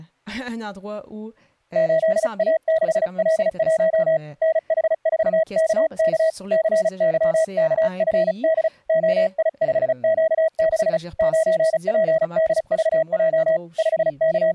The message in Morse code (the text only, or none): 8A6L1 NH4KK CYKFD OI5Q6 9PDVJ …